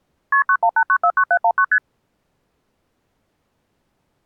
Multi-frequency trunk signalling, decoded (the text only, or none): KP 918949719 ST